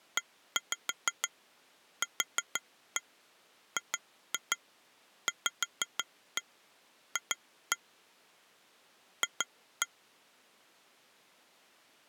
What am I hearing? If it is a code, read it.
Tap code, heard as taps on glass, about 6 knocks a second. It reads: EQGVF F